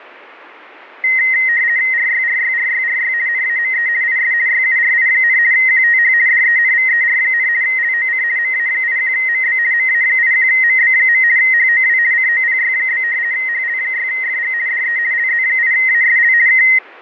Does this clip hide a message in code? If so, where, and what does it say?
Yes: RTTY (50 baud, 170 Hz shift) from 1.0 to 16.8 s, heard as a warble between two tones, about 1950 Hz centre, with fading. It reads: RYRYRYRY NAME IS YURI, QTH DENVER, LOC MA81MB MA81MB. HOW COPY? HL6FG DE LZ8ASL K